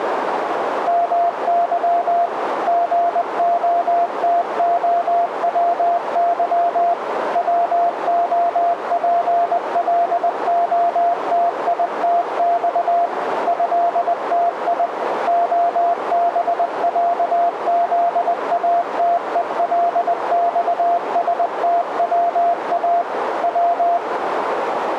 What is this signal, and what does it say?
Morse code (Russian alphabet), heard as a keyed tone, machine-sent, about 20 wpm, 690 Hz, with radio static and a narrow filter. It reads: МЫ ГОТОВЫ ВОПЛОТИТЬ ЭТИ ОБЯЗАТЕЛЬСТВА В